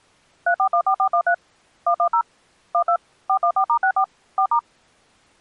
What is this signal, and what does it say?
DTMF, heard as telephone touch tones, dialled by machine, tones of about 80 ms. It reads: 3414413 110 12 414*64 4*